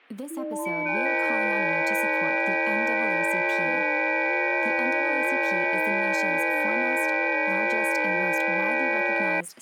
FT8 (several signals at once), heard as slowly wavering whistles, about 6.25 baud, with static crashes and speech in English.